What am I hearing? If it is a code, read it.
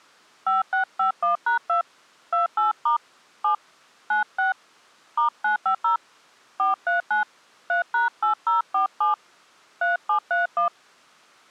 DTMF, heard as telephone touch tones, dialled by hand, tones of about 120 ms. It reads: 5651#2 28* 7 96 *950 439 3#8047 3731